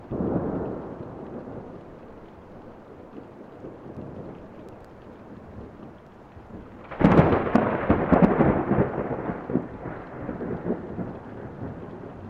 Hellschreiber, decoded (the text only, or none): none